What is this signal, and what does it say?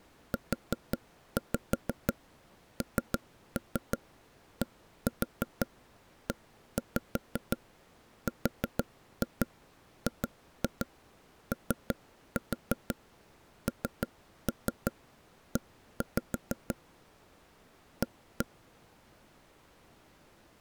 Tap code, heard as taps on a table, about 6 knocks a second. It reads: UNDERGONE A